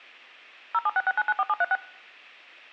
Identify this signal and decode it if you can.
DTMF, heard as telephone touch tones, dialled by machine, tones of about 40 ms. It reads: 0766994736